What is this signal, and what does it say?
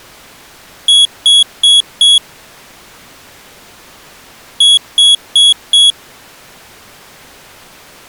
Beep code, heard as a piezo beeper, played twice, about 3350 Hz. 4 short. In AMI BIOS tables: system timer failure; in Dell tables: memory read or write failure.